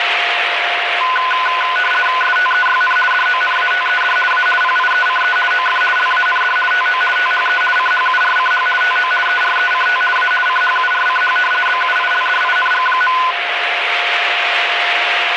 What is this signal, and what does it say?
RTTY (50 baud, 450 Hz shift), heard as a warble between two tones, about 1250 Hz centre, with radio static and a steady whistle near 700 Hz. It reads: STEYN DONATED A PIECE OF LAND TO THE CHURCH TO ERECT A CHURCH BUILDING.